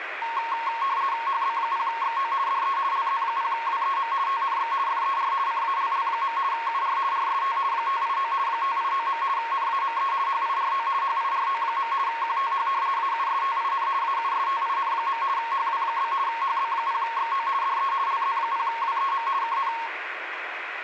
RTTY (50 baud, 170 Hz shift), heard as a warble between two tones, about 1000 Hz centre, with radio static. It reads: HB0XO DE LZ0WEM TNX FER CALL. UR RST 589 589. NAME HIRO HIRO. QTH AUSTIN AUSTIN. HW? HB0XO DE LZ0WEM KN